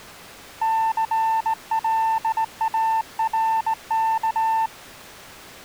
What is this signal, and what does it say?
Morse code, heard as a keyed tone, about 18 wpm, 890 Hz. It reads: CLARK